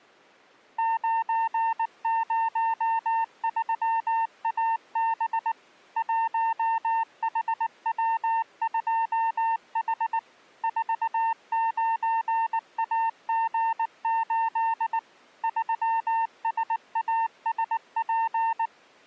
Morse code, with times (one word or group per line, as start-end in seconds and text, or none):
0.8-5.5 903AB
6.0-10.2 1HW2H
10.6-15.0 49AG8
15.4-18.7 3SASP